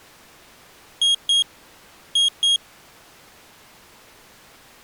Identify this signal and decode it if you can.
Beep code, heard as a piezo beeper, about 3250 Hz. 2-2.